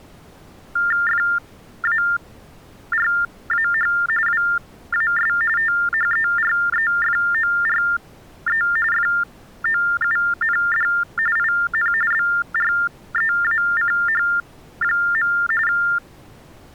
TTY/TDD text telephone tones (45.45 baud Baudot), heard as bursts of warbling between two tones, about 400 Hz shift, 1600 Hz centre. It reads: FARAH WAS THEREFORE FOUND IN BREACH. …